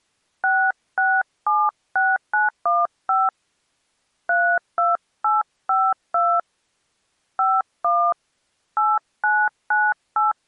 DTMF, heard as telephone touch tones, dialled by hand, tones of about 220 ms. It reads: 6676915 32852 51 8998